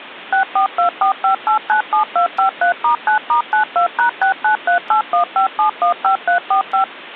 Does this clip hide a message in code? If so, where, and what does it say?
Yes: DTMF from 0.3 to 6.8 s, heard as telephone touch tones, dialled by machine, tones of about 110 ms. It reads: 64245897253*9*92#693815715345